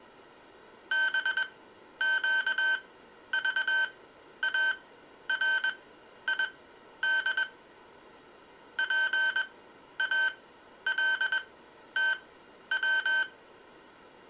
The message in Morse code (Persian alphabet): بگذارید پالتو

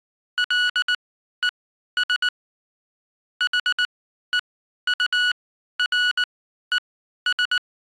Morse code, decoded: LES HEURES

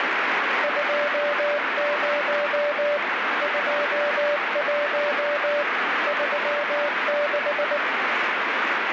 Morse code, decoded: 20 21 36

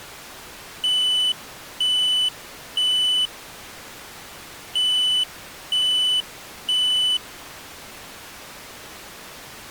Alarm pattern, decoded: temporal three

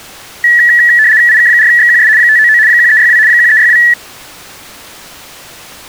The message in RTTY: IK4XQS 599 1362 1362

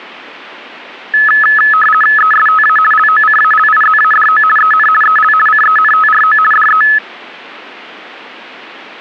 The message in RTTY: ESTA LOCALIZADO EN EL CENTRO DE

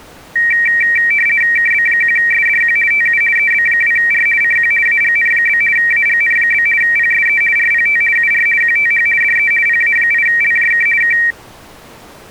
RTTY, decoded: KB1SDQ TU EB2R CQ AGN? AGN? PSE RPT UR QTH DE PA8LJK K

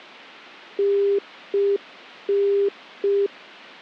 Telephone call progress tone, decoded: congestion tone

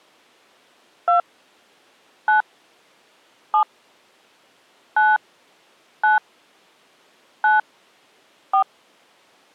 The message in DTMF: 2 9 7 9 9 9 4

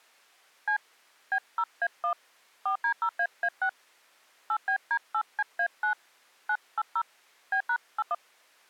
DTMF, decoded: C B0A1 4D0AA6 8BD8CA9 980 B#81

